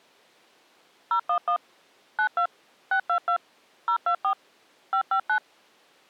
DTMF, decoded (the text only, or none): 011 92 622 024 559